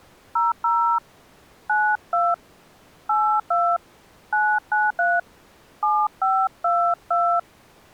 DTMF, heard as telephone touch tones, dialled by hand, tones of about 250 ms. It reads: 00 92 82 993 7522